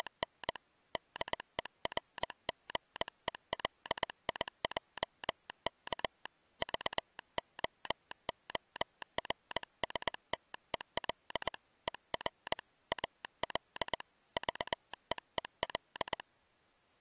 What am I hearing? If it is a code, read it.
Morse code, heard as a telegraph sounder, hand-sent with a paddle, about 20 wpm. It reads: … DERGELIJK VOORSTEL ER AL VEEL